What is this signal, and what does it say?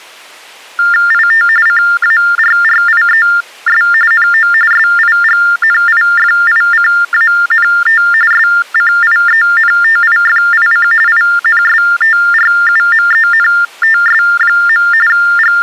TTY/TDD text telephone tones (45.45 baud Baudot), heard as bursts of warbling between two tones, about 400 Hz shift, 1600 Hz centre. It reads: IT CARRIES NO SIGNIFICANT SCIENTIFIC INSTRUMENTS. …